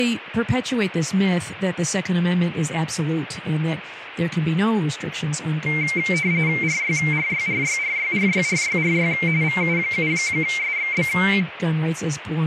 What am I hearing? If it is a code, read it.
RTTY (45.45 baud, 170 Hz shift), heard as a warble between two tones, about 2200 Hz centre, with radio static and speech in English. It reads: RYRYRYRYRYRYRY VU7SXB